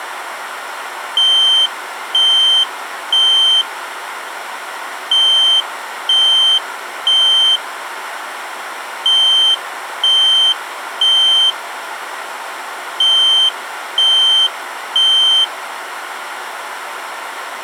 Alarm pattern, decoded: temporal three

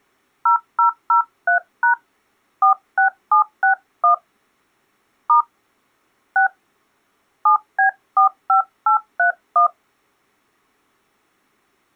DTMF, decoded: 0003# 46761 * 6 7B45831

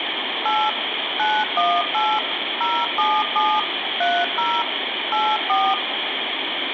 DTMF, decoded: 8 918 077 30 84

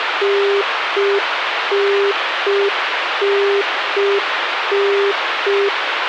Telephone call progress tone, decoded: congestion tone

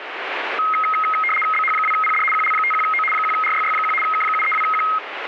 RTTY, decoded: BH2PD QL51O 1RYY1 K732Q

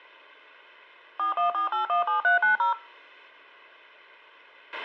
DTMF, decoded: 414817390

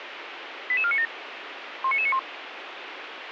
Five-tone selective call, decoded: 88497 19991

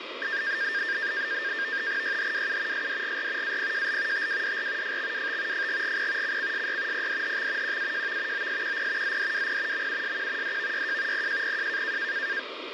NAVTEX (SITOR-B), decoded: YHWU SDGR APJL TWDR FXWT FGGP CCSY PDHX QAJV OSQP ZDWP MUSQ DVYJ PJPJ

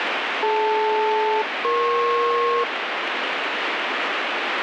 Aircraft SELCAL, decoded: DL-EP

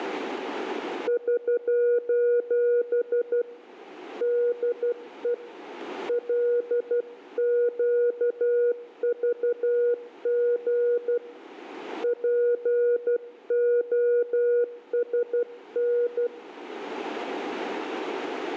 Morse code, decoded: <SOS> DE LQVG POSN

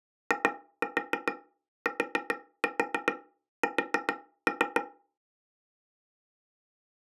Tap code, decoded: ITS

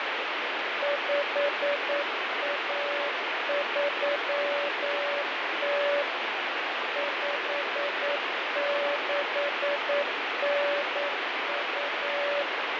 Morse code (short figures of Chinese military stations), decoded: 5130 5692

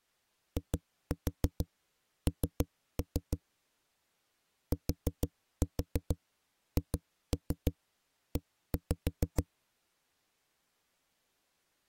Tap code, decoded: IN THE

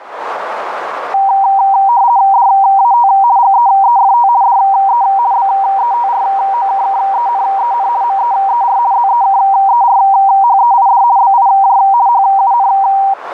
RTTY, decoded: DAT GEEFT DE BETROKKENEN MEER ZEKERHEID BIJ HUN

